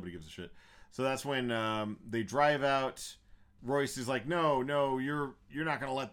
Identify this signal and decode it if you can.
Speech in English. There is no code.